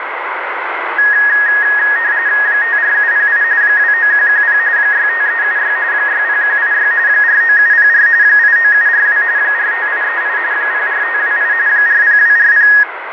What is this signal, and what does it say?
RTTY (45.45 baud, 170 Hz shift), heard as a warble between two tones, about 1750 Hz centre, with radio static. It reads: 54708 29110 65376 60186 49704 89742 45838 04528 40240